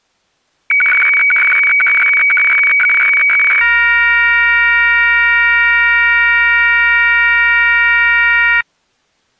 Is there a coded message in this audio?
Yes: weather fax (radiofax), 120 lines a minute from 0.7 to 8.6 s, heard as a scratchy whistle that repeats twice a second.